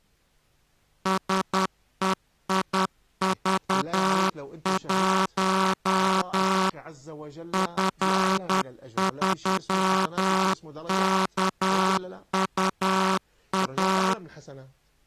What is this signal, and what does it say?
Morse code, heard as a buzzer, machine-sent, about 10 wpm. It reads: SEIV1 F3KUA